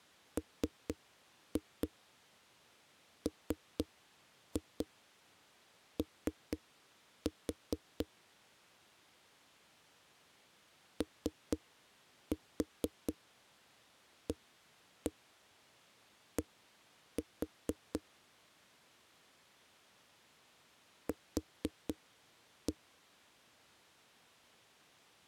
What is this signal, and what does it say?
Tap code, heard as knocks on a wall, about 4 knocks a second. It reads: MMO OAD Q